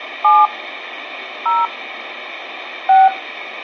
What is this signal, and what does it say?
DTMF, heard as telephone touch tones, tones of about 210 ms, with radio hiss. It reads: 7 0 6